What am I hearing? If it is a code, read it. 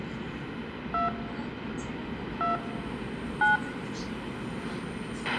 DTMF, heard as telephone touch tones, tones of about 150 ms, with a squelch burst at the end, room echo and the noise inside a subway train. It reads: 2 2 9